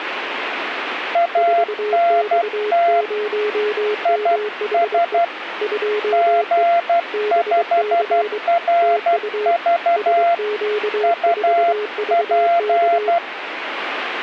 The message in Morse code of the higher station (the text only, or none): ANT IS G5RV UP